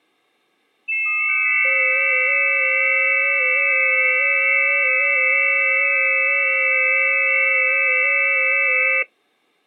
FT8 (several signals at once), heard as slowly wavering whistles, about 6.25 baud.